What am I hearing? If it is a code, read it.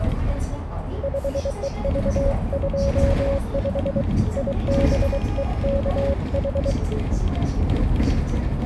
Morse code, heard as a keyed tone, hand-sent with a bug key, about 23 wpm, 550 Hz, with radio static, a narrow filter and the noise inside a bus. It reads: 5EV25 IBEKH